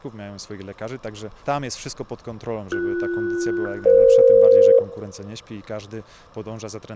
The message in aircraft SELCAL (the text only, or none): BS-EF